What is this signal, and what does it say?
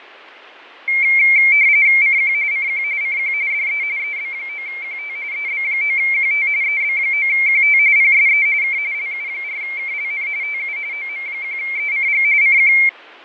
RTTY (45.45 baud, 170 Hz shift), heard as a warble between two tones, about 2200 Hz centre, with radio static and fading. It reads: CQ CQ CQ DE EB9QT EB9QT EB9QT PSE K LU4KLN TU OM1ECG CQ